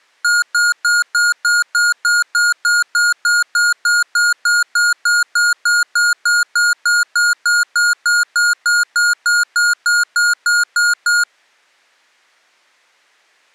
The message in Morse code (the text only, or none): none